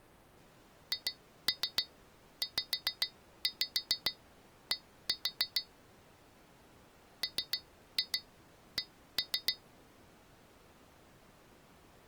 Tap code, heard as taps on glass, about 7 knocks a second. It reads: HZD MC